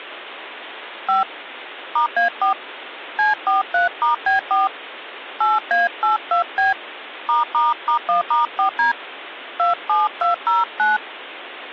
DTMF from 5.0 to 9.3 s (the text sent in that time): 8A82B ***1*4D